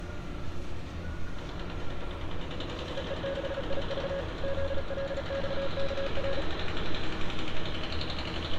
Morse code, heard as a keyed tone, machine-sent, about 36 wpm, 550 Hz, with street noise. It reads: EE6IV ZLXKR